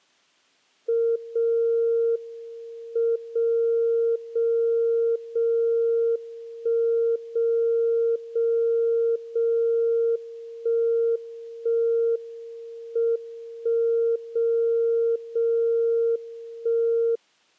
Radio time signal (WWVB), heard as a tone whose level steps once a second, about 460 Hz. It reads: 0 M 0 0 0 1 0 0 0 1 1 M 1 0 0 1